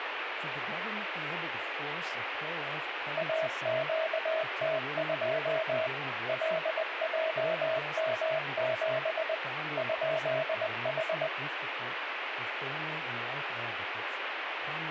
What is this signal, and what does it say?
Morse code, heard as a keyed tone, machine-sent, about 20 wpm, 640 Hz, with radio static and speech in English. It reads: AQT2 LJM7 ?H